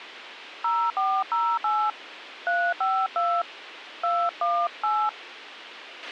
DTMF, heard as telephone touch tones, dialled by hand, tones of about 260 ms, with radio hiss and a squelch burst at the end. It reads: 0408 352 218